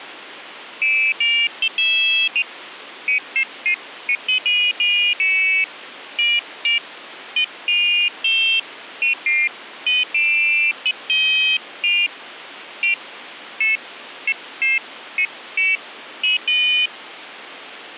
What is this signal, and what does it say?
Pairs of high tones at irregular times. There is no code.